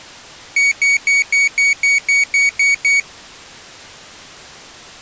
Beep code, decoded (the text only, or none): 10 short